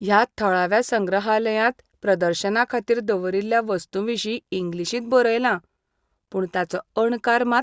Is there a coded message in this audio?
No, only speech in Goan Konkani.